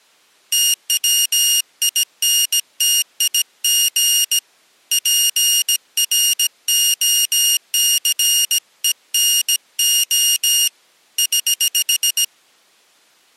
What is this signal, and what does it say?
Morse code, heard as a high beeper, hand-sent with a bug key, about 17 wpm, 2850 Hz. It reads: TWINTIG PROCENO <HH>